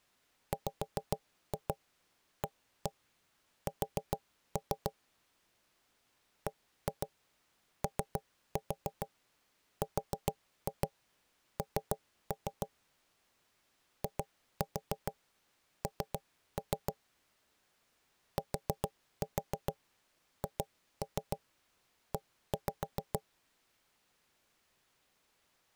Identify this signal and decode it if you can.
Tap code, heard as knocks on wood, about 7 knocks a second. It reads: WAS BORN IN THE